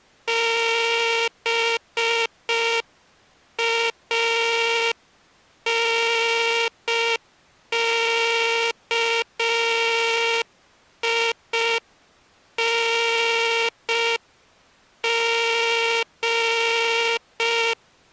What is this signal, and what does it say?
Morse code, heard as a buzzer, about 5 wpm. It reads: BANKING